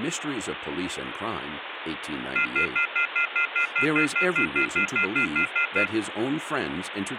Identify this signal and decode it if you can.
Telephone call progress tone (North American plan), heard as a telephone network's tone, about 1400, 2050, 2450, 2600 Hz, 0.1 s on and 0.1 s off, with phone line noise. Off-hook warning tone.